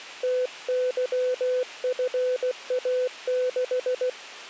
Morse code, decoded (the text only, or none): TYFA6